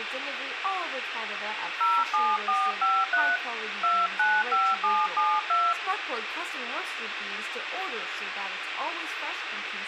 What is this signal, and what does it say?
DTMF, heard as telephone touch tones, dialled by hand, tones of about 230 ms, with phone line noise. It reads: 07453 295772